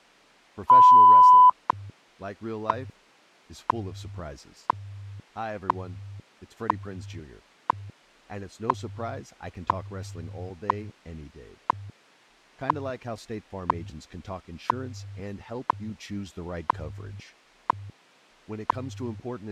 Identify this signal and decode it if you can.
Radio time signal (WWV, Colorado), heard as ticks, one a second, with speech in English.